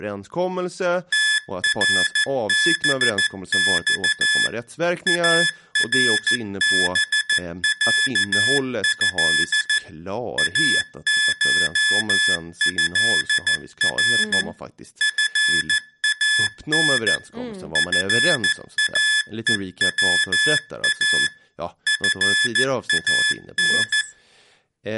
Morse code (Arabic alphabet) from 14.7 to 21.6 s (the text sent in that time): فان فاءوا